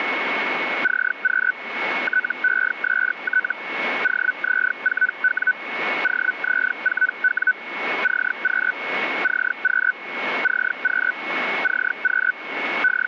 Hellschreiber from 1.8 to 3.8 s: TEST

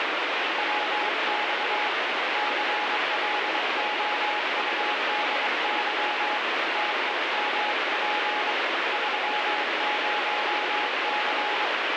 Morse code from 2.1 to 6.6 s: CLOUDY

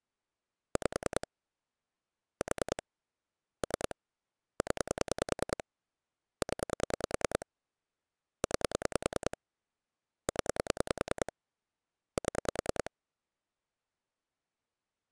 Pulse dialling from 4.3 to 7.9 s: 0 0

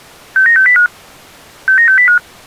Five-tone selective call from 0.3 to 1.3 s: 69605

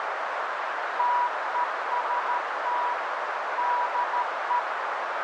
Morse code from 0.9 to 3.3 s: TEST

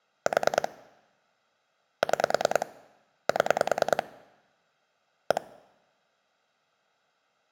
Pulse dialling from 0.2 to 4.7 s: 4 6 7

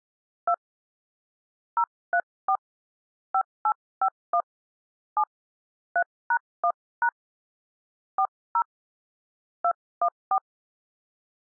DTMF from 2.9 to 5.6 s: 5851 7

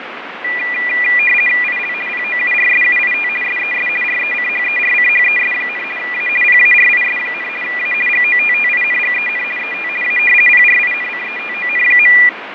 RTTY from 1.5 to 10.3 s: IL POURSUIT SES RECHERCHES, A PARIS, A GOTTINGEN ET A

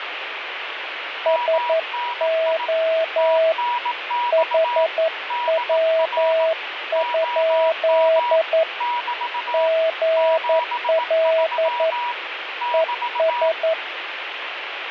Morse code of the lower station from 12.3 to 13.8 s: ES

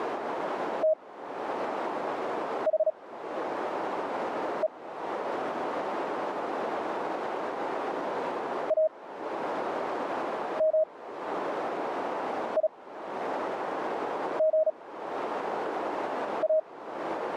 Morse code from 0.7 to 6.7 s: THE

